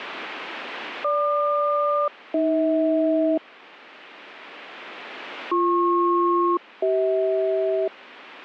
Aircraft SELCAL, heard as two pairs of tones. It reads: GQ-AH BP-CH